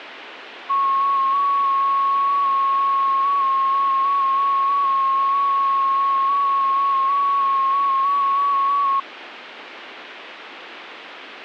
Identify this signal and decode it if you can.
FT8 (one signal), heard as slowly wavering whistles, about 6.25 baud.